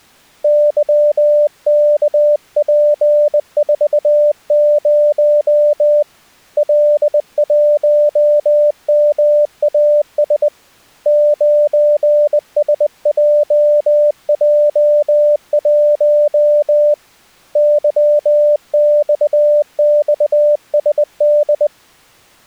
Morse code, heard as a keyed tone, hand-sent with a bug key, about 20 wpm, 590 Hz. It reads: YKP40 L1MAS 9SJJ1 YXXSD